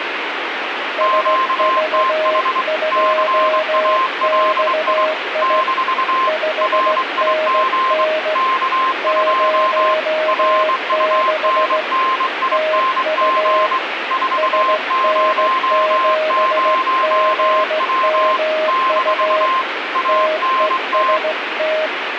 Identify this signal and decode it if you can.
Morse code, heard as two keyed tones, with radio static. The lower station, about 16 wpm, 620 Hz: SV2XI 5NN 06 TU SN7GMU TEST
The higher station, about 23 wpm, 1050 Hz: QTH CALI - RIG K2 RUNNING 400W - ANT